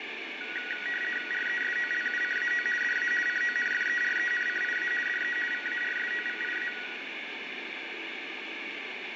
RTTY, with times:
1.3-2.7 RESOLUCAO
2.8-3.1 DA
3.3-4.9 CONFERENCIA
5.1-5.4 DE
5.5-6.7 VARSOVIA

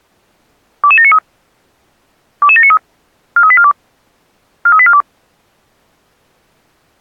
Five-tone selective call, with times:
0.8-1.2 22793
2.4-2.8 22793
3.4-3.7 43842
4.7-5.0 43842

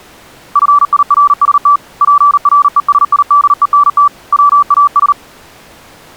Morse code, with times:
0.6-1.8 FIRST
2.0-4.1 PRESIDENT
4.3-5.1 WAS

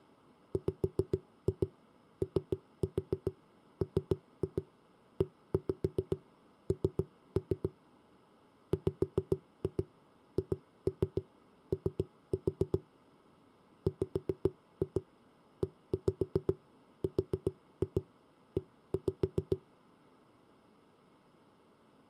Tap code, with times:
0.5-7.7 WOMEN
8.7-12.8 WHO
13.9-19.6 WERE

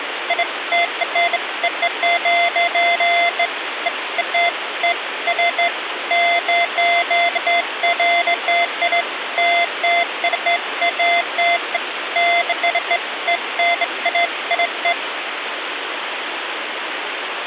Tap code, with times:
none

